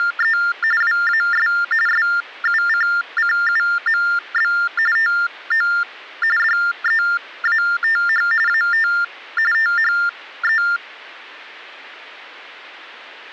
TTY/TDD text telephone tones (45.45 baud Baudot), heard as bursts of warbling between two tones, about 400 Hz shift, 1600 Hz centre. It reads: … WAS SUCCUMB TO DEATH AT THE